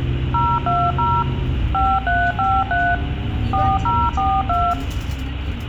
DTMF, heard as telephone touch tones, dialled by machine, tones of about 240 ms, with phone line noise and the noise inside a bus. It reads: 020 5353 4042